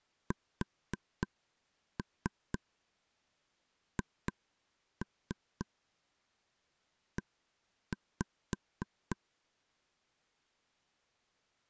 Tap code, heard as taps on a table, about 4 knocks a second. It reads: SHE